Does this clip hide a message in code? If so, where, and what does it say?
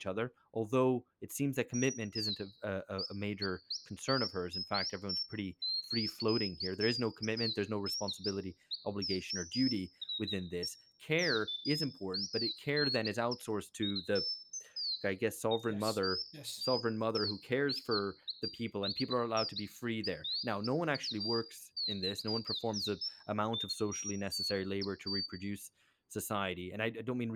No, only bird-like chirps, with room echo and speech in English.